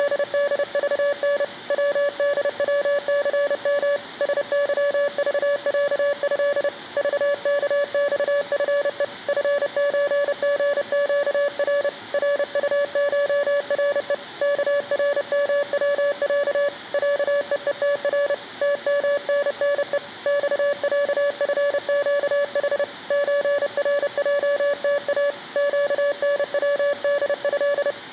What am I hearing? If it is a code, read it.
Morse code (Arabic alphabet), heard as a keyed tone, hand-sent with a paddle, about 30 wpm, 570 Hz. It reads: … ودوثم سظضعه ضكصفء فزغقر رطشرء كرموع عءءتر تمننء صعفقح زرجتا قنوده